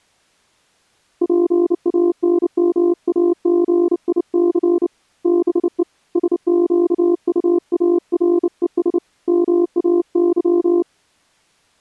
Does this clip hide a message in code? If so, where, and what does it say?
Yes: Morse code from 1.2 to 10.9 s, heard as a keyed tone, hand-sent with a bug key, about 29 wpm, 350 Hz. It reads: PANMAGIC BE SQUARES MAY